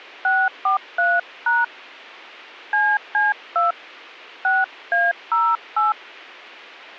DTMF, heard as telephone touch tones, dialled by hand, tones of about 180 ms. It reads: 643# CC2 6A08